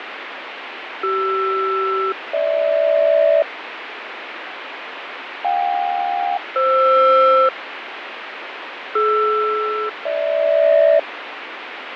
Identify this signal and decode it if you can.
Aircraft SELCAL, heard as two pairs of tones, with radio static and fading. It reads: CR-GH JK-FR DR-GH